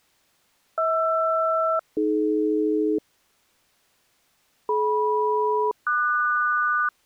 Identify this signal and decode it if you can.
Aircraft SELCAL, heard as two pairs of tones. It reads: HR-AD DM-QS